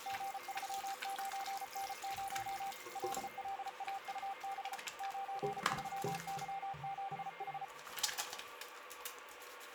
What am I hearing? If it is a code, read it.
Morse code, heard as a keyed tone, machine-sent, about 34 wpm, 780 Hz, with radio static, a weaker station near 2120 Hz and the noise of a restroom. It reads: G39N0 LLAUB 93Y7H